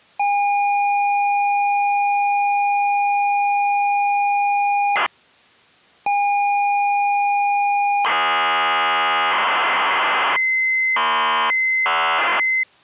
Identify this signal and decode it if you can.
ZX Spectrum tape loading, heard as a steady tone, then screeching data.